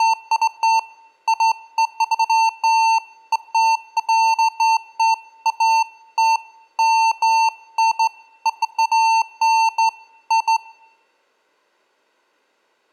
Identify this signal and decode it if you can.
Beeps of irregular length, with room echo. There is no code.